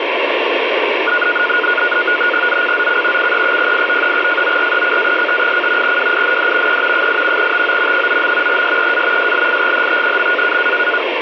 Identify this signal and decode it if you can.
NAVTEX (SITOR-B), 100 baud, 170 Hz shift, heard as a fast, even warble, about 1360 Hz centre, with radio static. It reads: ZCZC CE08 FORECAST: WIND E 8 TO 9. SEA SLIGHT.